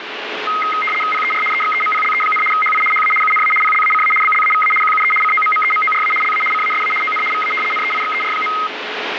RTTY (75 baud, 850 Hz shift), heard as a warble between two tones, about 1700 Hz centre, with radio static. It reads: PER EXEMPLE, HI HA UNA PLACA BLAVA QUE COMMEMORA LA CASA ON VA NEIXER.